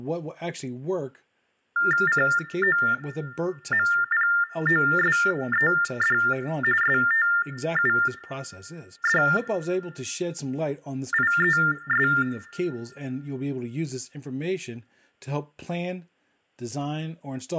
TTY/TDD text telephone tones (45.45 baud Baudot), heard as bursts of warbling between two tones, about 400 Hz shift, 1600 Hz centre, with room echo and speech in English. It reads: COMPOSED STUDIES